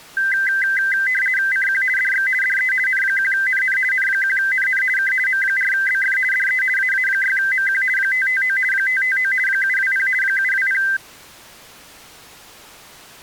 RTTY (50 baud, 450 Hz shift), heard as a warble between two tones, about 1800 Hz centre. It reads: CQ DX DE N1NN N1NN K M4BF DE AA6MQ 559 559 720 720